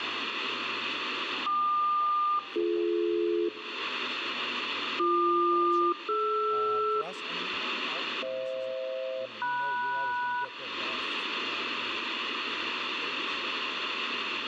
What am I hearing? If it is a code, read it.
Aircraft SELCAL, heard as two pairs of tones, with radio static and room echo. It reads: KQ-BD BQ-DR FH-MS